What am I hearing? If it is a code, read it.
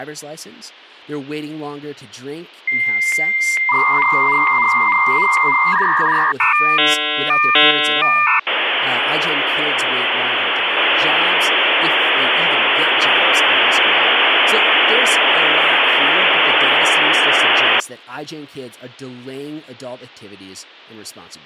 Dial-up modem handshake (V.34 or later), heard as a whistle, warbles, then hiss, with speech in English.